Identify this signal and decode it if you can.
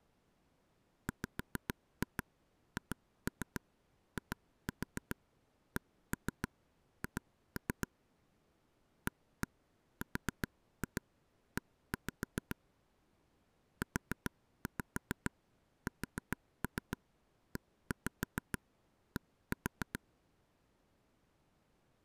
Tap code, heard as taps on a table, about 7 knocks a second. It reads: WHICH ARE USED